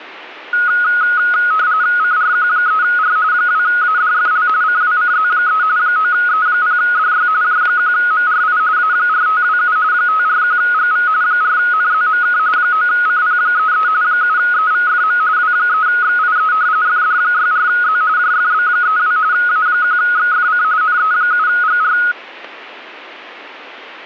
RTTY (45.45 baud, 170 Hz shift), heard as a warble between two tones, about 1360 Hz centre, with static crashes. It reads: CRQ3R 2ADFL CWCZ3 9E0DY J1MRI A4527 541GV 4NZMK 9CP33 7EVFM W3XIE FD64Z JFB32 A1XFC NE7GR